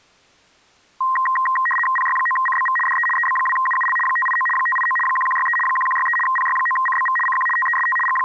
RTTY (75 baud, 850 Hz shift), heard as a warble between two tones, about 1470 Hz centre. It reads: PY9CBV DE EB2UUL 589 589 1163 1163 PY9CBV CQ TEST …